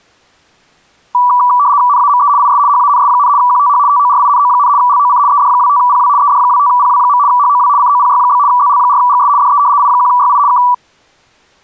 RTTY (75 baud, 170 Hz shift), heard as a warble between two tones, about 1070 Hz centre. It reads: NAME IS HANS, QTH TORINO, LOC ED25PW ED25PW. HOW COPY? ZL4GS DE I1YI K